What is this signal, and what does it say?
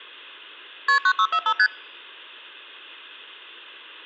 Multi-frequency trunk signalling (R1, as on North American trunks), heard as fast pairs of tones, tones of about 70 ms. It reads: KP 9645 ST